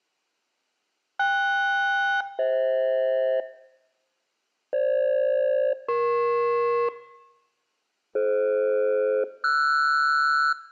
Aircraft SELCAL, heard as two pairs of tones, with room echo. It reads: KS-FH FG-EP DF-RS